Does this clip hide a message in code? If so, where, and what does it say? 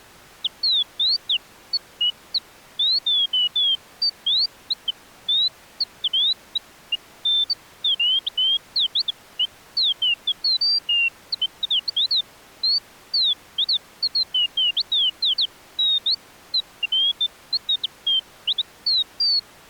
No, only bird-like chirps.